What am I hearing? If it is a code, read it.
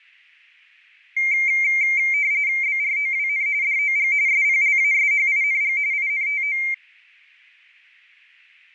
RTTY (45.45 baud, 170 Hz shift), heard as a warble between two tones, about 2200 Hz centre. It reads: BROWN DOG SPLASHING INTO